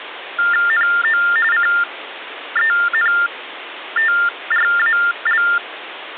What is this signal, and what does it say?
TTY/TDD text telephone tones (45.45 baud Baudot), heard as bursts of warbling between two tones, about 400 Hz shift, 1600 Hz centre, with phone line noise. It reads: NO CENTRAL